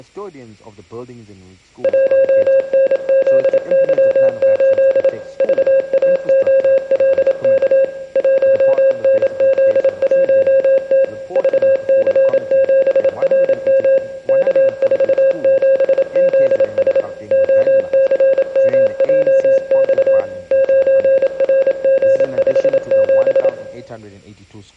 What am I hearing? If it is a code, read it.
Morse code, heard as a keyed tone, machine-sent, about 27 wpm, 540 Hz, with room echo. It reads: 1NZY8 VAOLK 1NZ1T VC7RM K47ZS OCMJX 9RG57